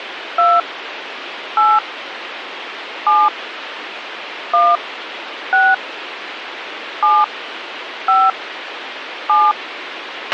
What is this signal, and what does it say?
DTMF, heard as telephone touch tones, dialled by hand, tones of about 220 ms, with radio hiss and a squelch burst at the end. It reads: 2 8 7 1 6 7 5 7